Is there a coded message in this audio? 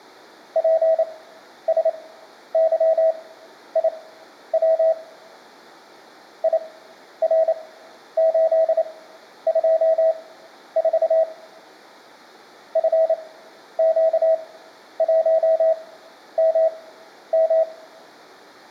Yes: Morse code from 0.5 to 17.7 s, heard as a keyed tone, machine-sent, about 28 wpm, spaced as for 11 wpm, 650 Hz, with room echo. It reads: PSYIW IR824 FQ1MM